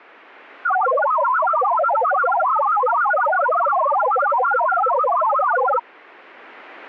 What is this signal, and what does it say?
Multi-tone FSK (Olivia or MFSK type), about 1000 Hz wide, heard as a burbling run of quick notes, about 62.5 baud.